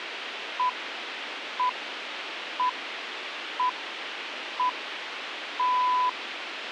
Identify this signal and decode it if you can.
Radio time signal (six pips, as the Greenwich Time Signal), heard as pips, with radio hiss.